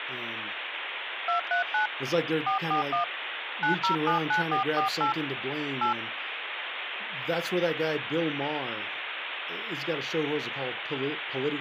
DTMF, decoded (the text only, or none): 239 441 9079448 8